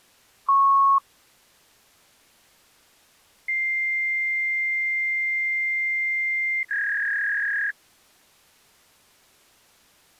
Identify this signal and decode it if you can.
Fax machine handshake, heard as a beep, a long tone and a warble.